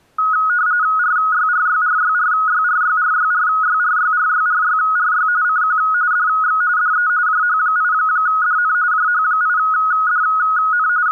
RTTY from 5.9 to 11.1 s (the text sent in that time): DX DE JH8DN JH8DN …